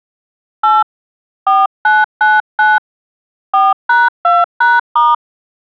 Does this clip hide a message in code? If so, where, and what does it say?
Yes: DTMF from 0.6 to 5.1 s, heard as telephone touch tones, dialled by hand, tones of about 190 ms. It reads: 8 4999 4#2#*